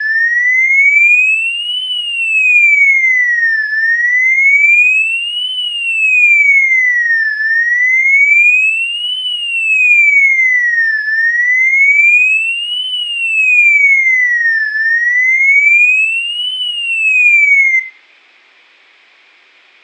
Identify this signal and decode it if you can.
A tone that sweeps in pitch again and again, with room echo. There is no code.